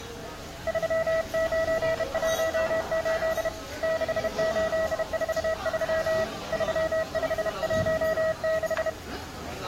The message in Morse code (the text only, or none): 3918 6843 3516